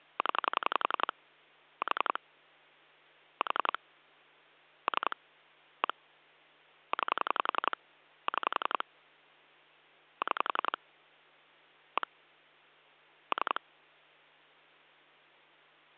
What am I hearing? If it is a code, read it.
Pulse dialling, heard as clicks on a phone line, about 11 pulses a second, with hum. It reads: 0 4 4 3 1 9 6 6 1 3